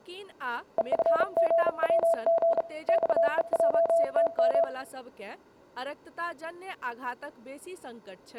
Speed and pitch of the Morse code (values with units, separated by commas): 35 wpm, 670 Hz